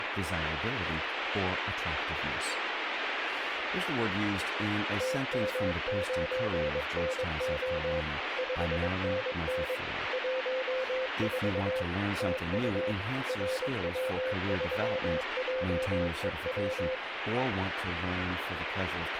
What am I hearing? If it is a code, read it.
Morse code, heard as a keyed tone, machine-sent, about 22 wpm, 520 Hz, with radio static and speech in English. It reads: TM9NO 5NN 14 TU RW3JEW